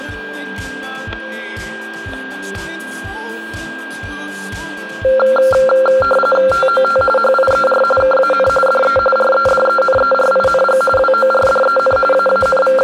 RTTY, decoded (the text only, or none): TOT HIER KAN DE REDENERING WORDEN …